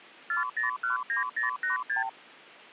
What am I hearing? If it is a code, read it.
Multi-frequency trunk signalling (R2, with the far end's replies), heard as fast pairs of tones, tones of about 130 ms. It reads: 4019086